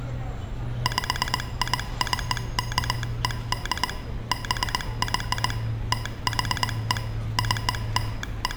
Morse code (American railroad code), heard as a telegraph sounder, machine-sent, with room echo and street noise. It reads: PICKED BY THE …